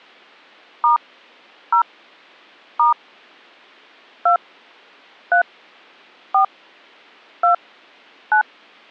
DTMF, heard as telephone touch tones, dialled by hand, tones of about 110 ms. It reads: * 0 * 2 3 4 2 9